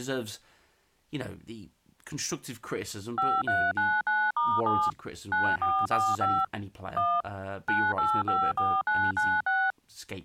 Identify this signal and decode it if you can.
DTMF, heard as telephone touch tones, dialled by machine, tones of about 240 ms, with speech in English. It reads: 5399*7 9445 1 9854996